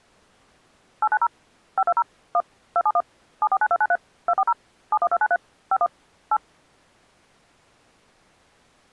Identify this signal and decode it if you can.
DTMF, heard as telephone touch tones, dialled by machine, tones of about 50 ms. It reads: 890 520 1 271 749293 240 71293 51 8